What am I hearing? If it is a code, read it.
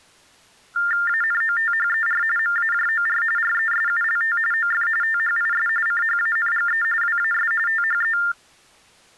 TTY/TDD text telephone tones (45.45 baud Baudot), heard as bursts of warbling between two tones, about 400 Hz shift, 1600 Hz centre. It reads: ANOTHER MAJOR RESULT OF THIS CHANGE WAS THE